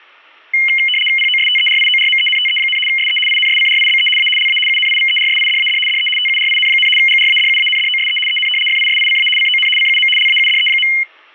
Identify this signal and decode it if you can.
RTTY (75 baud, 850 Hz shift), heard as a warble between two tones, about 2550 Hz centre, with static crashes. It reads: POSTERIORMENTE, SE INSCRIBE A LA UNIVERSIDAD DE TURIN, GRADUANDOSE EN FISICA CON CUM LAUDE.